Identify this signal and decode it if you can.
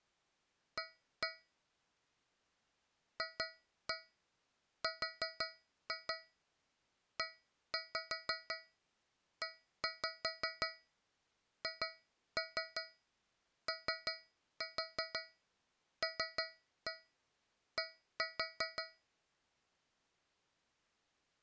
Tap code, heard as taps on a metal pipe, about 5 knocks a second. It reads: A FREEHOLD